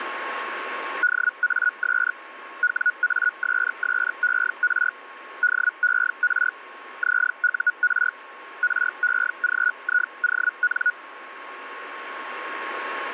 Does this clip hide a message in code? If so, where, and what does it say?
Yes: Hellschreiber (Feld-Hell, 122.5 baud) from 1.0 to 10.9 s, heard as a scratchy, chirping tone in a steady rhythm, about 1460 Hz, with radio static and a steady whistle near 1090 Hz. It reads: DAS WASSER DER ZUR REGION